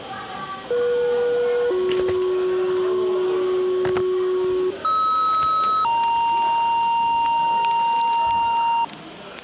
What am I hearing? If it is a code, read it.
Two-tone page, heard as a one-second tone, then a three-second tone, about 480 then 370 Hz, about 1290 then 930 Hz, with the noise of a cafe.